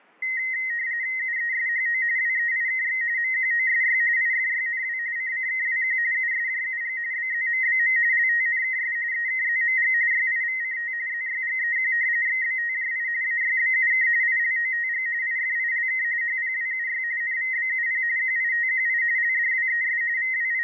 RTTY (45.45 baud, 170 Hz shift), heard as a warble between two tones, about 1950 Hz centre, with fading. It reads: UESHO WEIKX MQOSY IFYNW CCKWQ USJUG BZMBM LTNKS EKZMG YIVCT ZYGEQ XBTJI AYBUK ILOTG IFILK HPWUY NVBUP QITQI LDWES …